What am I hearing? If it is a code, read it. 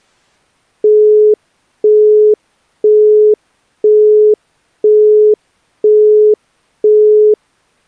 Telephone call progress tone (single-tone plan, as in Europe, Japan and elsewhere), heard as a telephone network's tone, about 420 Hz, 0.5 s on and 0.5 s off. Busy tone.